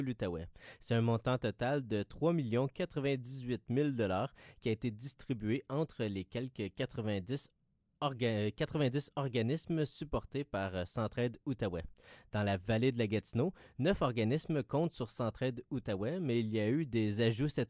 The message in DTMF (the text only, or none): none